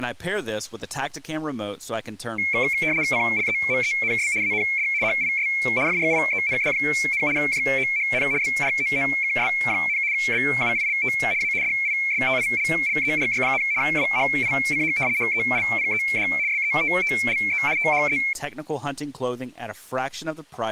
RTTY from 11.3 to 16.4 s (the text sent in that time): A DISTILLERY, WHICH HELPED